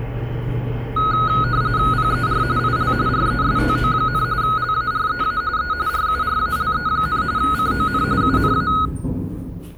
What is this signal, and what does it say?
RTTY (45.45 baud, 170 Hz shift), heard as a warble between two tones, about 1360 Hz centre, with the noise inside a lift. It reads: PER IL RESTO, LAREA E RURALE, CON UNA